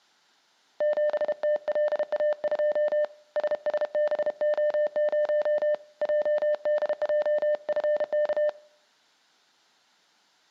Morse code, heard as a keyed tone, hand-sent with a paddle, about 32 wpm, 600 Hz, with room echo. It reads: 7TLA2 SSBO0 JDJFK